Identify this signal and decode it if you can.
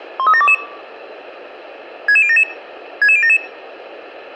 Five-tone selective call (ZVEI), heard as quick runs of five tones, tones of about 70 ms, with a squelch burst at the end. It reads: 13722 66077 66077